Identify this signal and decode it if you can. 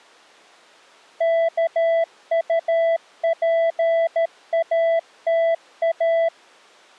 Morse code, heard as a keyed tone, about 13 wpm, 660 Hz. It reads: KUPATA